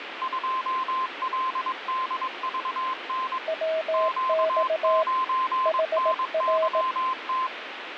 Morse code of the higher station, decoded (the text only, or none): 2LDVN Q9NYT